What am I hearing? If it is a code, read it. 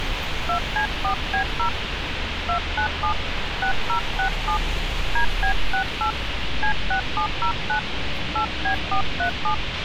DTMF, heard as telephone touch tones, dialled by hand, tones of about 100 ms, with radio hiss, a squelch burst at the end and street noise. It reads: 2C4B0 297 6067 DB68 C6709 8B437